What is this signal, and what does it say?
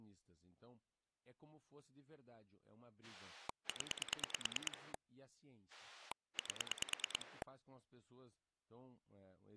Pulse dialling, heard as a rotary dial, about 9 pulses a second, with speech in Portuguese. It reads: 0 8